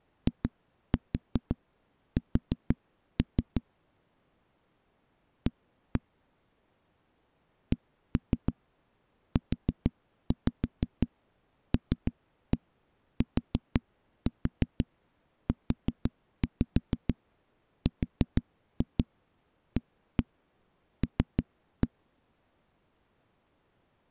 Tap code, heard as knocks on a wall, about 6 knocks a second. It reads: IS A CULTURAL